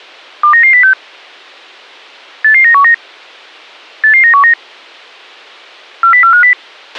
Five-tone selective call (CCIR), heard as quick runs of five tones, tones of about 100 ms, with a squelch burst at the end. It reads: 29906 88919 88919 40450